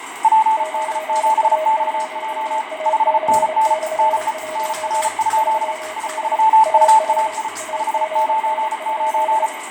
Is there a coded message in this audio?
Yes: Morse code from 0.2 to 9.5 s, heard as two keyed tones, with radio static, fading and the noise of a restroom. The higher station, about 34 wpm, 880 Hz: PD7XJ 5NN NE NR? I3UAI 599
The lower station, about 28 wpm, 630 Hz: 9A0AC/1 3D AR AGN?